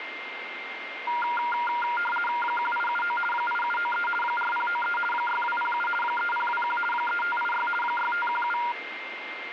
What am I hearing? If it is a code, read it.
RTTY (50 baud, 450 Hz shift), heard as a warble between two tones, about 1180 Hz centre, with radio static and a steady whistle near 2110 Hz. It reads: 1879 8793 4093 6207 3021 3586 6517